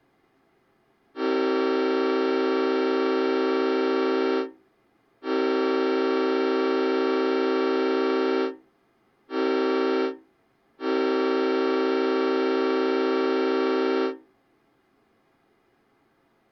Train horn signal, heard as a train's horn. 2 long, 1 short, 1 long. On North American railways: approaching a public crossing.